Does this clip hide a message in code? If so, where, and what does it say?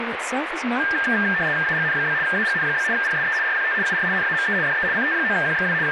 Yes: RTTY (75 baud, 170 Hz shift) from 0.8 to 5.9 s, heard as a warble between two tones, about 1700 Hz centre, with radio static and speech in English. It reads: AGN? AGN? PSE RPT UR NAME DE CT9QXW …